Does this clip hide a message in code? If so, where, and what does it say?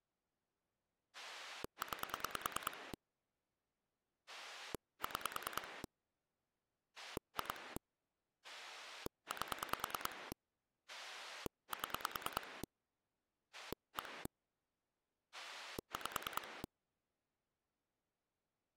Yes: pulse dialling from 1.1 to 16.7 s, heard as a rotary dial, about 9 pulses a second. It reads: 9 6 2 8 7 1 5